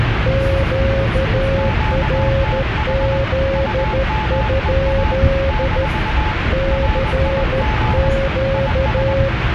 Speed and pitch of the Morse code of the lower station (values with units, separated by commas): 13 wpm, 540 Hz